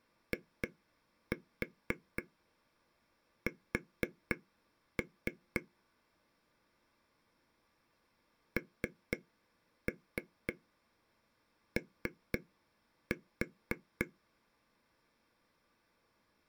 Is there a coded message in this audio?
Yes: tap code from 0.3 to 14.0 s, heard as taps on a table, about 4 knocks a second. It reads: IS NO